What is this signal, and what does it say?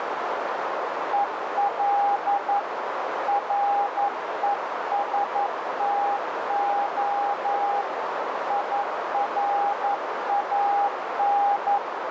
Morse code, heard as a keyed tone, hand-sent with a paddle, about 11 wpm, 810 Hz, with heavy radio static and a narrow filter. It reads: EL RESTO IRAN